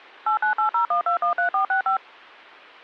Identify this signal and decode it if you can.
DTMF, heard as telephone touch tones, dialled by machine, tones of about 110 ms. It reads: 89801213465